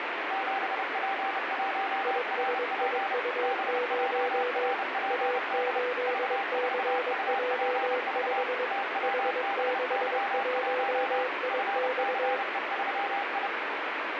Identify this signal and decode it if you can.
Morse code, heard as two keyed tones, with heavy radio static. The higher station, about 30 wpm, 790 Hz: 7P1RP BJRPD V4UPV TWBY1 FCE3I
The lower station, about 22 wpm, 500 Hz: ISIU0 A8CJ5 H61IX